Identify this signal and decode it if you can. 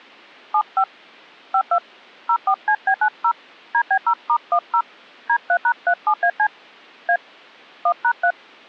DTMF, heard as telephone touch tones, dialled by hand, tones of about 70 ms. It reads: 75 52 04CB90 DB0*10 D3#37AC A 1#3